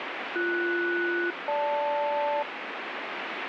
Aircraft SELCAL, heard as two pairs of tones, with radio static. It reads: BS-GL